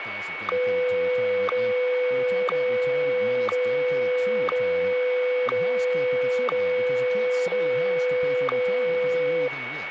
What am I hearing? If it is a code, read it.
Radio time signal (WWVH, Hawaii), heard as ticks, one a second, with radio static, a steady whistle near 2230 Hz and speech in English.